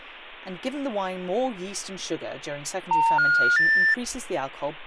Telephone call progress tone (North American plan), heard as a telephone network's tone, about 910, 1430, 1800 Hz, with speech in English. Special information tone.